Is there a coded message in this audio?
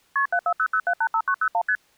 Yes: multi-frequency trunk signalling (R1, as on North American trunks) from 0.2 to 1.8 s, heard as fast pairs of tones, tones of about 70 ms. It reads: KP 7400785901 ST